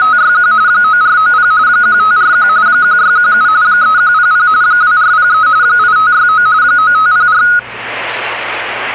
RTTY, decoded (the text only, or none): … 9490 1541 1617 3100 2403 8569 9504